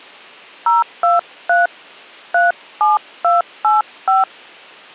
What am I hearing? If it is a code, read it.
DTMF, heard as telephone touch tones, dialled by hand, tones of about 160 ms. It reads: 023 37285